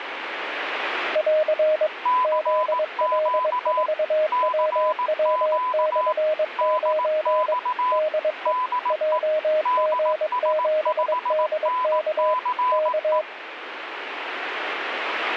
Morse code, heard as two keyed tones, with radio static. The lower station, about 22 wpm, 620 Hz: <AR> ZL4WW/9 DE JG7DK K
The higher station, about 18 wpm, 1010 Hz: CQ CQ DX DE DS5NCE